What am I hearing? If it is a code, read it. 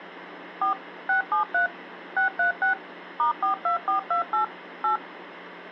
DTMF, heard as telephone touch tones, dialled by machine, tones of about 120 ms. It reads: 4 673 636 *42428 8